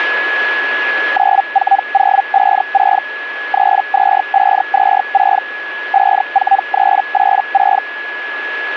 Hellschreiber (Feld-Hell, 122.5 baud), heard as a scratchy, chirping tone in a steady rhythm, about 790 Hz, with radio static and a steady whistle near 1690 Hz. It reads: 94056 32526 54386